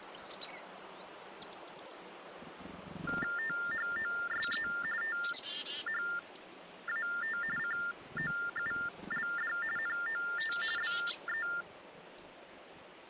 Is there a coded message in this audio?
Yes: TTY/TDD text telephone tones (45.45 baud Baudot) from 3.1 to 11.6 s, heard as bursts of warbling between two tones, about 400 Hz shift, 1600 Hz centre. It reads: THOSE THAT COULD NOT BE